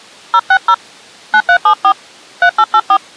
DTMF, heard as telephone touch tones, dialled by hand, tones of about 70 ms. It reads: 060 9374 3884